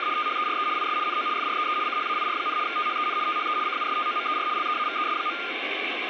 RTTY (75 baud, 170 Hz shift), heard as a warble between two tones, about 1310 Hz centre, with radio static. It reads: … THERE IS NO FREE CHAIR, THEN THE CUSTOMER LEAVES.